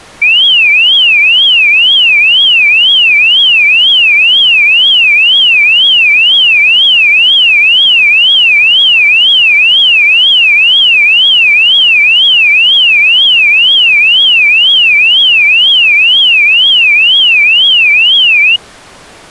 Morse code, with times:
none

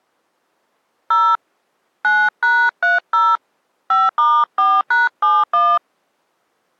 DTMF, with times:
1.1-1.4 0
2.0-3.4 9#30
3.9-5.8 5*4#71

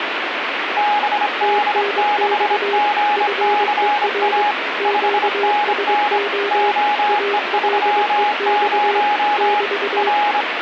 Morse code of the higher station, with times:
0.8-4.5 BD6GCA
4.8-6.2 5NN
6.5-9.6 OE30
10.0-10.4 R

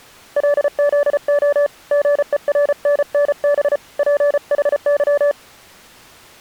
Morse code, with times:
0.4-1.7 LZO
1.9-3.8 GERNNB
4.0-5.3 PHY

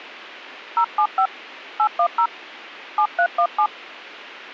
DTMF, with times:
0.8-1.3 075
1.8-2.3 810
3.0-3.7 7317

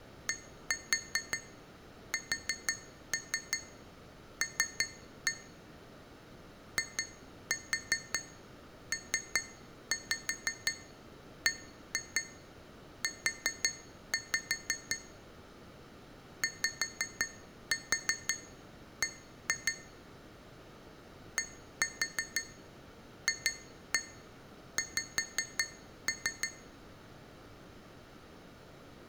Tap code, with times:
0.3-5.3 DSL
6.8-15.0 IPBU
16.4-19.7 YB
21.4-26.5 DFX

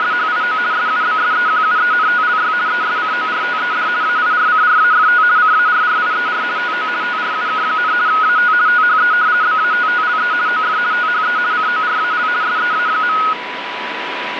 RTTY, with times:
0.0-0.6 …
0.7-2.5 SUBSEQUENTLY
2.7-3.9 ESCORTED
4.0-5.2 AIRCRAFT
5.4-6.4 CARRIER
6.6-6.9 TO
7.0-7.9 TRUK,
8.1-8.5 AT
8.7-9.1 THE
9.4-10.3 BATTLE
10.5-10.8 OF
10.9-11.4 THE
11.5-12.3 CORAL
12.4-13.2 SEA.

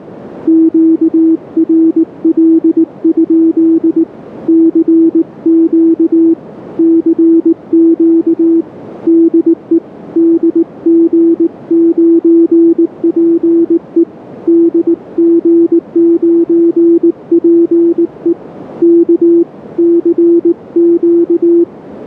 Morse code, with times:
0.5-4.0 QRL?
4.5-6.3 CQ
6.8-8.6 CQ
9.1-9.8 DE
10.2-14.0 DG9PE
14.5-18.3 DG9PE
18.8-19.4 K
19.8-21.6 CQ

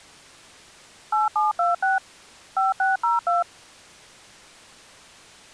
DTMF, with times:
1.1-2.0 8726
2.6-3.4 5602

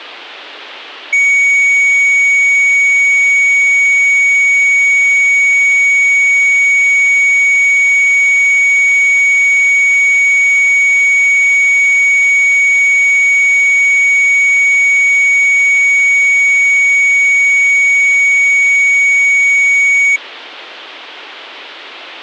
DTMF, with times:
none

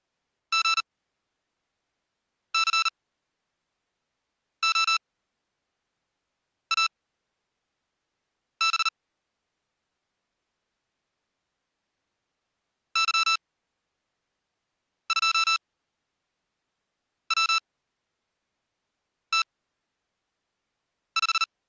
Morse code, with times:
0.5-8.9 GCOAB
13.0-21.4 Y2WT5

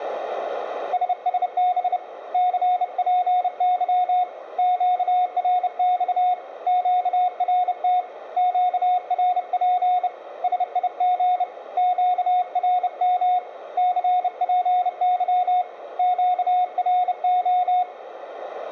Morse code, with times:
0.9-2.0 SSB
2.3-4.2 CPY
4.6-6.3 QRX
6.7-8.0 QRT
8.4-10.1 QRP
10.4-11.4 SIG
11.8-13.4 QRM
13.8-15.6 CPY
16.0-17.8 QRO

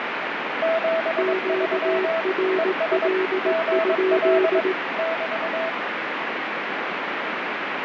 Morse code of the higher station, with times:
0.6-2.2 73
2.6-3.1 ES
3.5-4.6 GL
5.0-5.7 <BT>

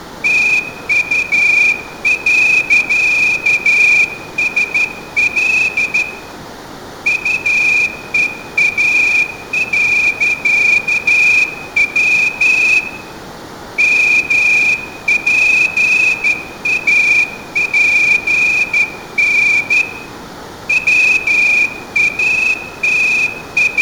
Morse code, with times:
0.2-6.0 TU.SL
7.1-12.8 UEA.W
13.8-19.8 MPAPN
20.7-23.8 …

